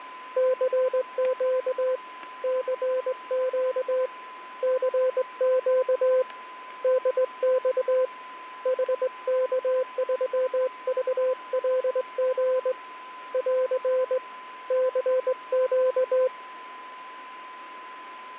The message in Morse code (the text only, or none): CQ CQ CQ DX HK3VLG <AR> CQ